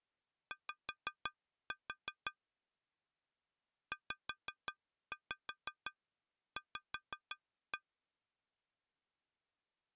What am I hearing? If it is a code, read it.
Tap code, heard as taps on glass, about 5 knocks a second. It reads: Y ZV